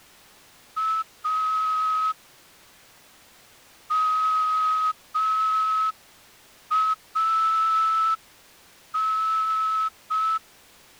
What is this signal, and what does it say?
Morse code, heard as a whistle, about 5 wpm. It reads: A MAN